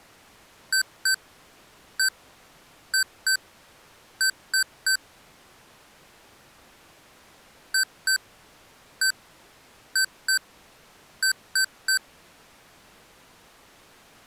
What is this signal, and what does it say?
Beep code, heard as beeps from a small speaker, played twice, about 1550 Hz. 2-1-2-3. In Phoenix BIOS tables: ROM copyright notice check failure.